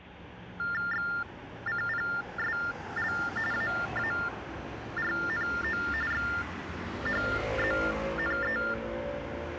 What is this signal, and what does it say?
TTY/TDD text telephone tones (45.45 baud Baudot), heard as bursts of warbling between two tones, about 400 Hz shift, 1600 Hz centre, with street noise. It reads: XCPSL AARNO XHZNE